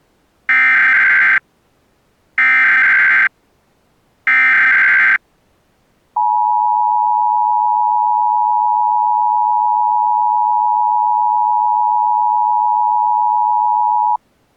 Emergency Alert System (SAME) tones (header bursts, then the 853 and 960 Hz attention tone), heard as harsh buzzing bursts, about 520.83 baud.